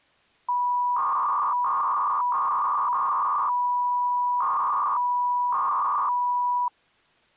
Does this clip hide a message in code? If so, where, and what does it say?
Yes: 300-baud modem data (V.21 tones) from 0.5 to 6.7 s, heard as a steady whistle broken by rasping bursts, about 300 baud, 200 Hz shift.